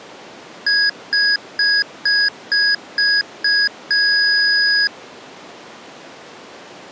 Beep code, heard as beeps from a small speaker, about 1650 Hz. 7 short, 1 long.